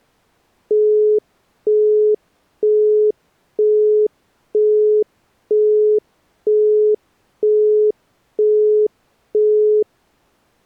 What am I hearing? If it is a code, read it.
Telephone call progress tone (single-tone plan, as in Europe, Japan and elsewhere), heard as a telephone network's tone, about 420 Hz, 0.48 s on and 0.48 s off. Busy tone.